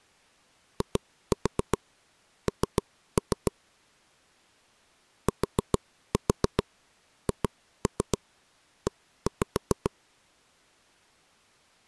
Tap code, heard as taps on a table, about 7 knocks a second. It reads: IN THE